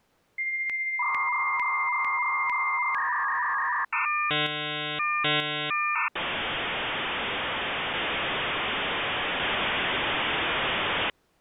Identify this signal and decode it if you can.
Dial-up modem handshake (V.34 or later), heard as a whistle, warbles, then hiss.